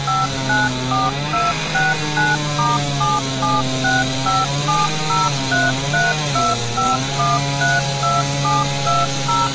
DTMF, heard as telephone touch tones, dialled by machine, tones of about 190 ms, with street noise. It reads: 594269*7765703325132720